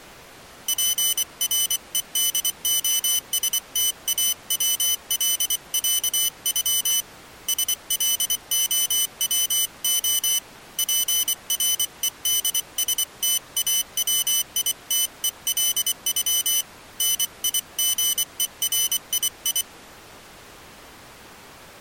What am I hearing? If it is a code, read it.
Morse code (Russian alphabet), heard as a high beeper, hand-sent with a paddle, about 24 wpm, 3000 Hz. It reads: ПРЕДОСТАВЛЯЮ СЛОВО ПРЕДСТАВИТЕЛЮ НИГЕРИИ